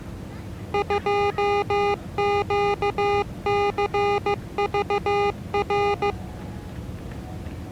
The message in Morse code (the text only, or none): 2QCVR